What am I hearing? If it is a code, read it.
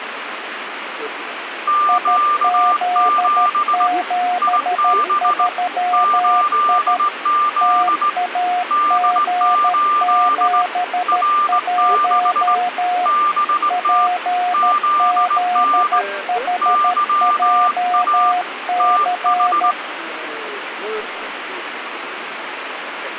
Morse code, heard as two keyed tones, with radio static. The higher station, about 19 wpm, 1190 Hz: Q7 IB 8Z D8 R6 BT ZN YA TH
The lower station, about 13 wpm, 720 Hz: IZ73I TAG71 PZHJC